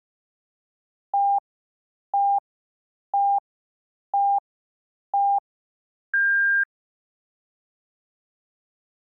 Radio time signal (five pips and a higher one, as on Chinese radio), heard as pips.